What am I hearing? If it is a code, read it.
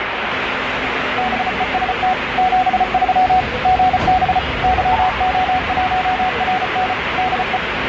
Morse code, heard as a keyed tone, machine-sent, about 34 wpm, 740 Hz, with radio static and the noise of a subway station. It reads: BEST 73 GB YO1RN DE